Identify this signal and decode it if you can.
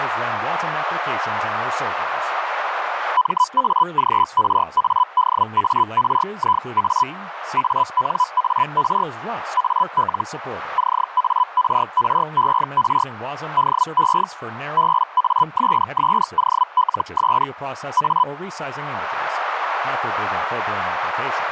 Hellschreiber (Feld-Hell, 122.5 baud), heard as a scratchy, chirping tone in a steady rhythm, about 1000 Hz, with radio static, a narrow filter and speech in English. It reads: MAGRADARIA ANAR AL CARRER DE BASSOLS A